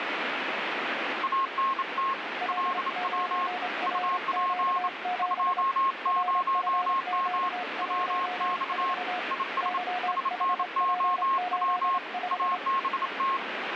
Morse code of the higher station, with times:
1.2-2.1 ANT
2.5-3.5 LW
3.9-4.9 UP
5.2-7.5 20M
7.8-8.9 WX
9.3-9.8 IS
10.1-12.0 SNOW
12.3-13.4 ABT

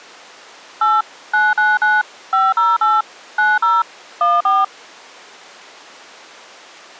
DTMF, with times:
0.8-1.0 8
1.3-2.0 999
2.3-3.0 508
3.4-3.8 90
4.2-4.6 14

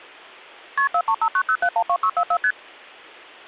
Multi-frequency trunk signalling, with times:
0.8-0.9 KP
0.9-2.4 43590712644
2.4-2.5 ST

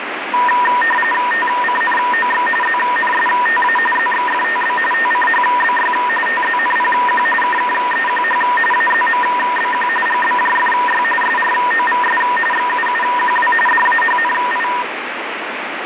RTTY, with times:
1.3-2.5 TCNOX
2.6-3.8 ZNSTA
4.0-4.8 ZXFTB
4.9-5.9 TCHBY
6.3-7.3 TZNPQ
7.4-8.4 KKEQH
8.7-9.9 AZMBQ
10.1-11.0 GBJFY
11.2-12.2 SROVS
12.5-13.5 XUUQW
13.7-14.7 DAHNI

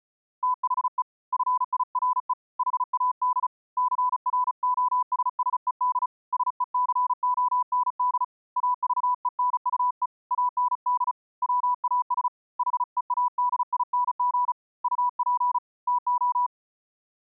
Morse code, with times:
0.4-1.0 THE
1.3-2.3 FIRE
2.6-3.5 HAD
3.8-6.1 CROSSED
6.3-8.2 SECOND
8.6-10.1 AVENUE
10.3-11.1 AND
11.4-12.3 WAS
12.6-14.5 HEADING
14.8-15.6 UP
15.9-16.5 TO

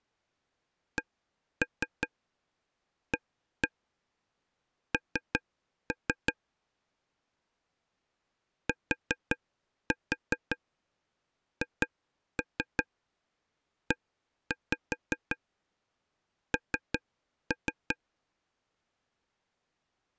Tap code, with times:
1.0-6.3 CAN
8.7-18.0 THEN

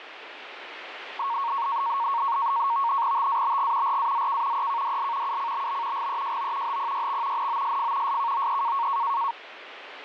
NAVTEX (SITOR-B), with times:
3.2-4.0 TABG
3.9-4.7 RAZK
4.6-5.4 EKDL
5.3-6.1 UCBB
6.0-6.8 GEJO
6.7-7.5 HPYX
7.4-8.2 NOSF
8.1-8.9 SKOE

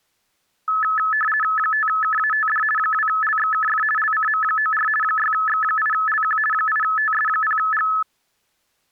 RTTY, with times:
1.6-2.6 5KATD
2.8-3.8 2LXKF
4.0-4.9 LCM94
5.0-6.4 6X8LQ
6.5-7.9 8TS0G

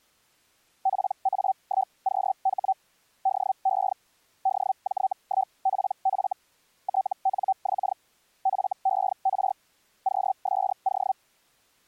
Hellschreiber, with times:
0.8-2.7 PA1QH
3.2-3.9 DE
4.4-6.3 DJ1PF
6.8-7.9 TNX
8.4-9.5 FER
10.0-11.1 QSO

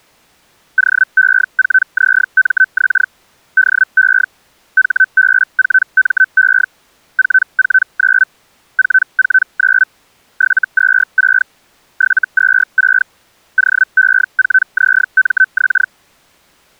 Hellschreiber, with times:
0.8-3.1 OE4ZMX
3.6-4.3 DE
4.8-6.7 HB4ME
7.2-8.3 449
8.8-9.9 449
10.4-11.5 726
12.0-13.1 726
13.6-15.9 OE4ZMX

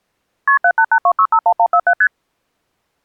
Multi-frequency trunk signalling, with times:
0.5-0.6 KP
0.6-1.9 7882651147
2.0-2.1 ST

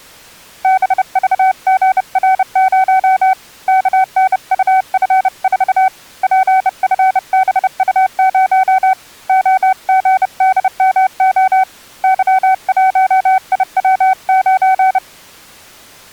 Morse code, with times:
0.6-3.3 BVGR0
3.7-5.9 KNUF4
6.2-8.9 PFBU0
9.3-11.6 OGDMO
12.0-15.0 Y1IW9

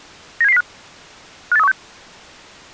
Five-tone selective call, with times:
0.4-0.6 97705
1.5-1.7 58316

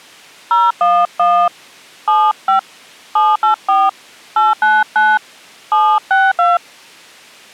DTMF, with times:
0.5-1.5 011
2.1-2.6 75
3.2-3.9 784
4.4-5.2 899
5.7-6.6 762

